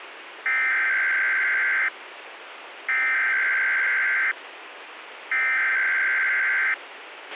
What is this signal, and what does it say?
Emergency Alert System (SAME) tones (header bursts), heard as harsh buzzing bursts, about 520.83 baud, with radio hiss and a squelch burst at the end.